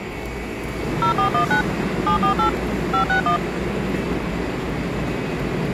DTMF, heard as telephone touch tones, dialled by machine, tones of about 100 ms, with the noise of a subway station. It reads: 0419 748 561